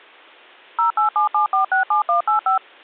DTMF, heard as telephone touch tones, dialled by machine, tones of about 120 ms. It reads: 0877467185